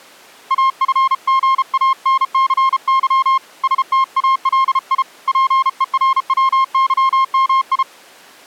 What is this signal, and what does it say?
Morse code (Russian alphabet), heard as a keyed tone, hand-sent with a paddle, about 33 wpm, 1060 Hz. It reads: АФГАНЦЫ СТАЛИ ПЕРВЫМИ